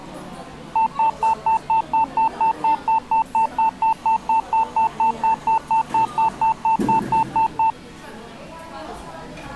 Evenly repeated beeps, with the noise of a cafe. There is no code.